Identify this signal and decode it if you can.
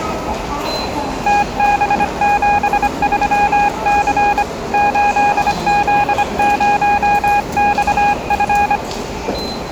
Morse code, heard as a keyed tone, hand-sent with a paddle, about 25 wpm, 820 Hz, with the noise of a subway station. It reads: TB73C 8Z0XF